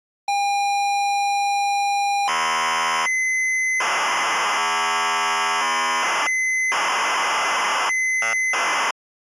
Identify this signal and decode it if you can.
ZX Spectrum tape loading, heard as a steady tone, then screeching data.